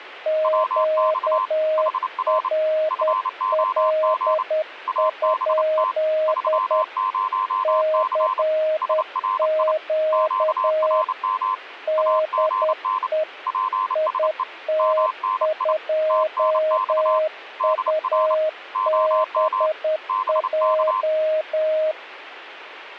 Morse code, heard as two keyed tones. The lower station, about 10 wpm, 620 Hz: QRL? CQ DE IT2UBJ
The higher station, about 29 wpm, 1030 Hz: WX HR FOG ABT 30C SRI QRM AGN PSE MNI TNX DR OM BK